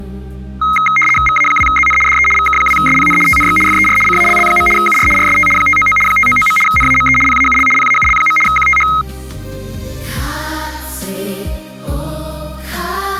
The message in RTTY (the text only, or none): VA2ZN DE VK2SPN TNX FER CALL. UR RST 599 599. NAME PAUL PAUL. QTH